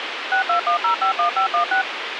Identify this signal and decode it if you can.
DTMF, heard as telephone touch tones, dialled by machine, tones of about 110 ms, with radio hiss. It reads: 621051516